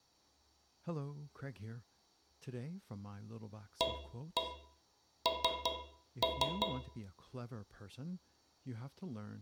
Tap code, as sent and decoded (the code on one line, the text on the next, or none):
1-1 3-3
AN